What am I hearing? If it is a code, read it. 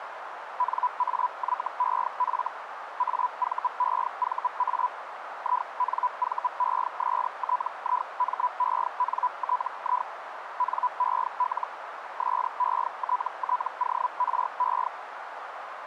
Hellschreiber (Feld-Hell, 122.5 baud), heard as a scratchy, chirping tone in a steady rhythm, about 990 Hz, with radio static and a narrow filter. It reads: NAYEF AVEVA INVESTIMENTI NEL SETTORE